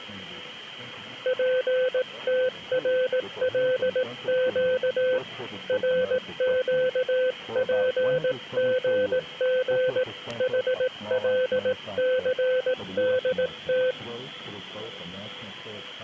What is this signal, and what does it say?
Morse code, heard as a keyed tone, hand-sent with a paddle, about 18 wpm, 510 Hz. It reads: PTRLQ RQPGG HLCDT